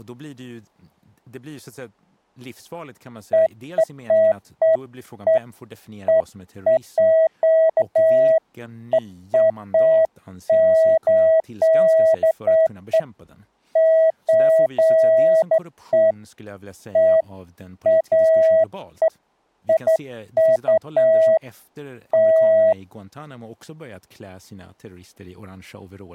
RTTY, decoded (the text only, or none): none